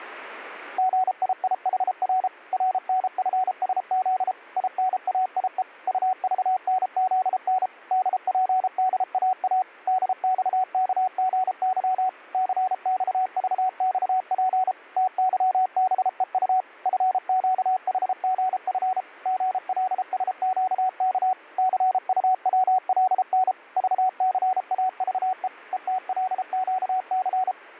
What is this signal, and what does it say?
Morse code, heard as a keyed tone, machine-sent, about 33 wpm, 750 Hz. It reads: GIIHR RNFSZ INAIE UVNZN DPDAA DXKGY CXVXP TYBEU FQHGF GLSQK CUWLN VCAVE ETLQC